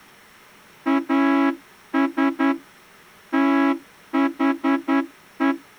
Morse code, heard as a horn, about 10 wpm. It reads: AS THE